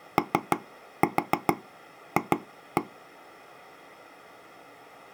Tap code, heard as taps on a table, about 6 knocks a second. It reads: OF